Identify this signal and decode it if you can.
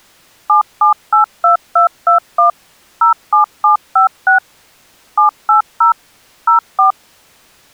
DTMF, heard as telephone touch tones, dialled by machine, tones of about 120 ms. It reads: 7782221 07756 780 04